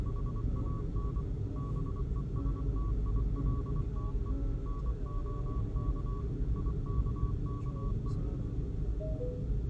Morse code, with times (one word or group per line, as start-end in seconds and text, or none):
0.1-1.2 HAN
1.6-4.3 BESTILTE
4.7-6.2 NOK
6.6-8.1 IKKE